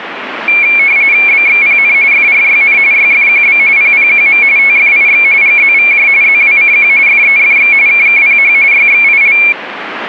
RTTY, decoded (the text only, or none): BXPN FRYN YFQB PPQM TFIX GZVJ ZWCQ FEFX KKPH YXIL